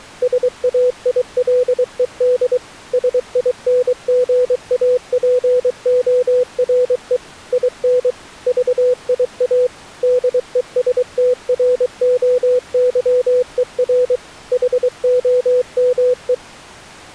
Morse code, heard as a keyed tone, machine-sent, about 23 wpm, 500 Hz. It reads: SAILED SINGAPORE IN VIA DESTROYER HOME